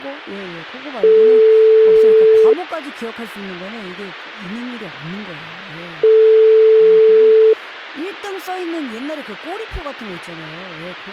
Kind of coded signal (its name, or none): telephone call progress tone